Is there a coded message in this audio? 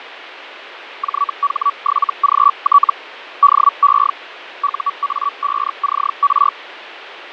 Yes: Hellschreiber (Feld-Hell, 122.5 baud) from 1.0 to 6.5 s, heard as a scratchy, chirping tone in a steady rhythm, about 1140 Hz, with radio static and fading. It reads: JH7GT DE UA5CR